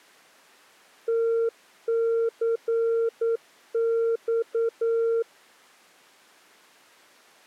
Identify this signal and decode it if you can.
Morse code (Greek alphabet), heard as a keyed tone, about 9 wpm, 460 Hz. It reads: ΤΘΞ